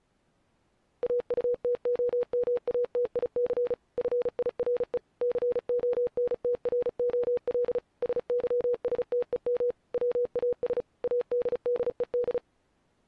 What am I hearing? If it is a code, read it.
Morse code, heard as a keyed tone, machine-sent, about 35 wpm, 490 Hz. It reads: AUTOMATIC FIRE CONTROL SYSTEM WAS ADDED